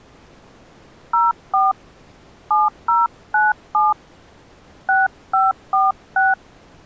DTMF, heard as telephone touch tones, dialled by hand, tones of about 180 ms. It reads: 04 7097 6546